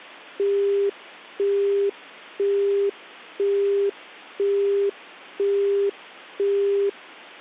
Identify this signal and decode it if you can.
Telephone call progress tone (single-tone plan, as in Europe, Japan and elsewhere), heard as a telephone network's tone, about 400 Hz, 0.5 s on and 0.5 s off. Busy tone.